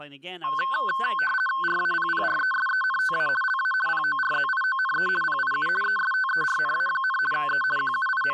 RTTY (50 baud, 450 Hz shift), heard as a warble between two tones, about 1290 Hz centre, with speech in English. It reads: RAPPRESENTA LA PORZIONE PIU ESTERNA, E …